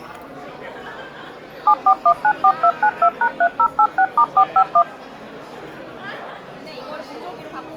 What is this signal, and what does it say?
DTMF, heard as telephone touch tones, dialled by machine, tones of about 70 ms, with the noise of a restaurant. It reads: 74194292#3086*451